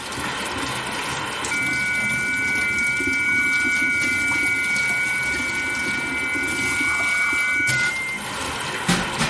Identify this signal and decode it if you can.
FT8 (several signals at once), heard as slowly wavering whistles, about 6.25 baud, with radio static, room echo and kitchen noise.